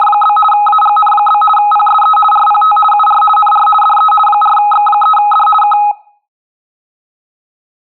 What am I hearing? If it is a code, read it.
RTTY (50 baud, 450 Hz shift), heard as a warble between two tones, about 1050 Hz centre. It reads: … AGN? PSE RPT UR NR DE 4X3D K